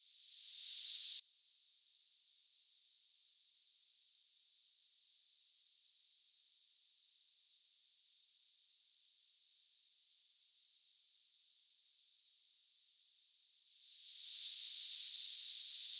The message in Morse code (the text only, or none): none